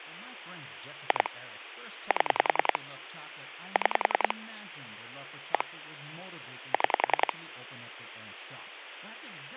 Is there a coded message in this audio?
Yes: pulse dialling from 1.1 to 7.3 s, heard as clicks on a phone line, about 10 pulses a second, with speech in English. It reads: 2 7 6 1 6